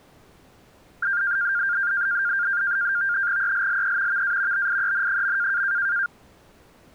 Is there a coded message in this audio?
Yes: NAVTEX (SITOR-B), 100 baud, 170 Hz shift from 1.0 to 6.1 s, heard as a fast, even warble, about 1500 Hz centre. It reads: ELLE VA BIEN.